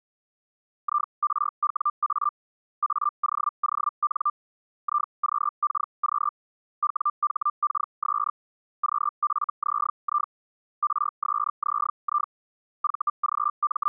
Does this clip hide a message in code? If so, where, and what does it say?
Yes: Hellschreiber (Feld-Hell, 122.5 baud) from 0.8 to 13.9 s, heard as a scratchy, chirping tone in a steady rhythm, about 1190 Hz. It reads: IRWA AOON IQKQ WHKS QFZI RSZI …